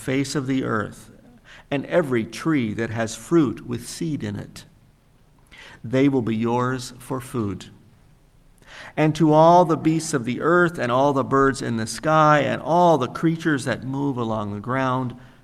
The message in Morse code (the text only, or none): none